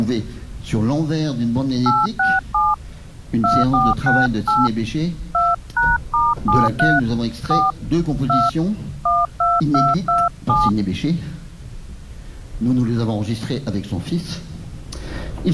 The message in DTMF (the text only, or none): 867 2468 2#*73 4 2 12227